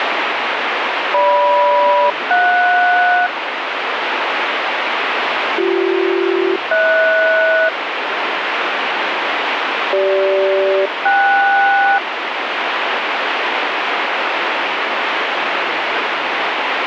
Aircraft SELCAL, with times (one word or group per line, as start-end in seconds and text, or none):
1.1-3.3 GM-JS
5.6-7.7 BC-HS
9.9-12.0 CG-KS